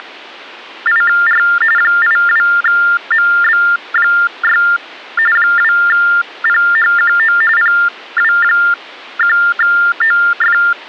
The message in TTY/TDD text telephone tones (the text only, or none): … 82MB6 2PHQO PW1OF